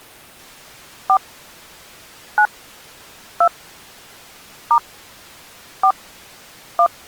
DTMF, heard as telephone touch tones, dialled by hand, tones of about 70 ms. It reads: 4 9 2 * 4 1